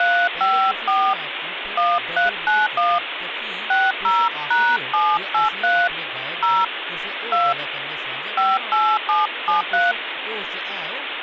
DTMF, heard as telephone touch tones, dialled by hand, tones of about 220 ms, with phone line noise and speech in Dogri. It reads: 354 1391 60#783 0 2 58773